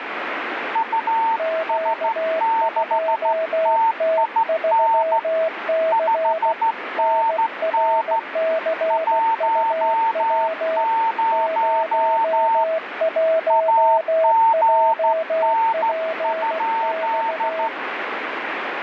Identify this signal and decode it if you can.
Morse code, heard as two keyed tones, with radio static. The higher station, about 14 wpm, 900 Hz: US6TIN 5NN 10 AGN?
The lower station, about 16 wpm, 650 Hz: Q2T3C NRCUW 01JPX